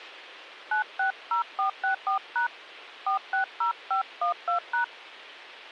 DTMF, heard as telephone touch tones, dialled by hand, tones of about 110 ms. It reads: 960464# 460512#